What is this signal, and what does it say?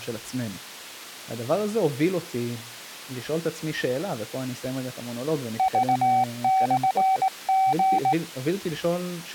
Morse code (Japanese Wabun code), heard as a keyed tone, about 18 wpm, 760 Hz, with speech in Hebrew. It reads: クモリ